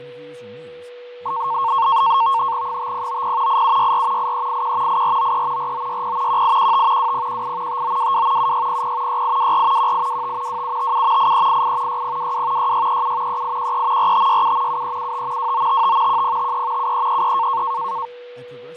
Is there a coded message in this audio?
Yes: NAVTEX (SITOR-B), 100 baud, 170 Hz shift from 1.3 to 18.1 s, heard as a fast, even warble, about 1000 Hz centre, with fading, a steady whistle near 490 Hz and speech in English. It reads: 5090 8764 8381 8493 4960 1815 2018 5922 7600 6824 1825 2757 8388 6022 6637 3813 4567 7375 2955 1053 7333